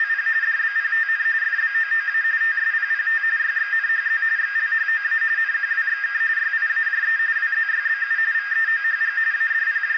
RTTY (45.45 baud, 170 Hz shift), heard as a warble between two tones, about 1700 Hz centre, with radio static and a narrow filter. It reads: … DBPTN FBOOA TSPPT YXNHZ XLHOA NQWXK YIAJE WZYBU VEOHG …